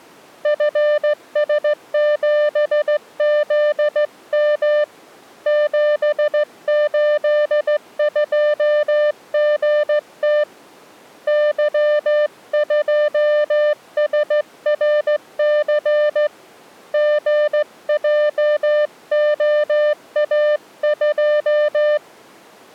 Morse code, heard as a keyed tone, hand-sent with a straight key, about 15 wpm, 600 Hz. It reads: FS7ZM 782GT Y2SRC GJOA2